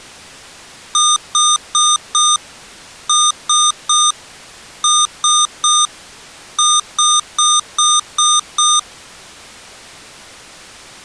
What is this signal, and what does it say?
Beep code, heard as beeps from a small speaker, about 1220 Hz. 4-3-3-6.